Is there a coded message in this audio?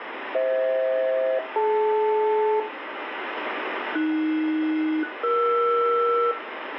Yes: aircraft SELCAL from 0.3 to 6.3 s, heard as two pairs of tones, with radio static and room echo. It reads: FH-DL AS-ER